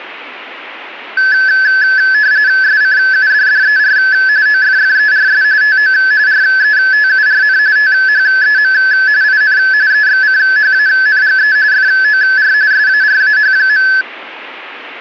RTTY (45.45 baud, 170 Hz shift), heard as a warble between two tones, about 1600 Hz centre. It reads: SCUDDER OFFERS TO RETURN THEM IN EXCHANGE FOR SARAH.